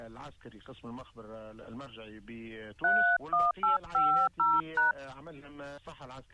DTMF, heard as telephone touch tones, dialled by hand, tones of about 230 ms. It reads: 31850#